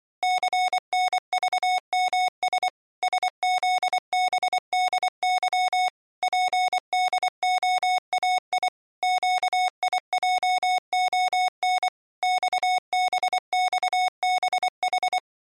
Morse code, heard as electronic beeps, machine-sent, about 24 wpm, 740 Hz. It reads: CNVMS SZBDY PDOAI QIJON XBXBH